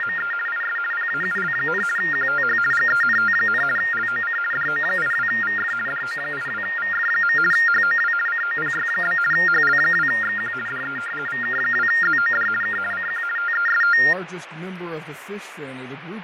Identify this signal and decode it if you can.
RTTY (50 baud, 450 Hz shift), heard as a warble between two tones, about 1600 Hz centre, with radio static and fading. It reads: … IS PAUL, QTH GENT, LOC DO82VF DO82VF. HOW COPY? HL2XQ DE VK2ZOD K CQ TEST